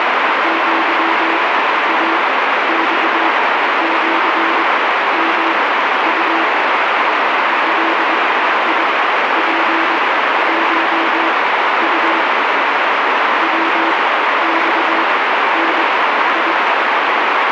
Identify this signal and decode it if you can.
Morse code (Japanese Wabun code), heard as a keyed tone, machine-sent, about 22 wpm, spaced as for 12 wpm, 330 Hz, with heavy radio static. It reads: アイマシヨウ ガツコウ ヤマダ